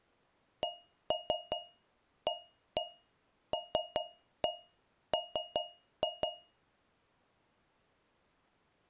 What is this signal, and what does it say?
Tap code, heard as taps on a metal pipe, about 5 knocks a second. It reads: CALM